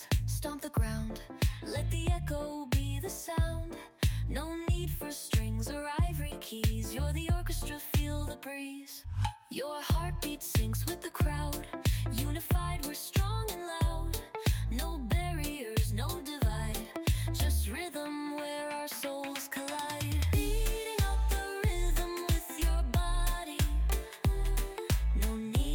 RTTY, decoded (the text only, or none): none